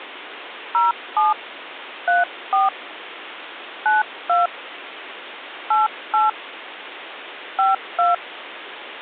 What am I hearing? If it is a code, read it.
DTMF, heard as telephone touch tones, dialled by hand, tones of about 160 ms, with phone line noise. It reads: 07 34 92 88 52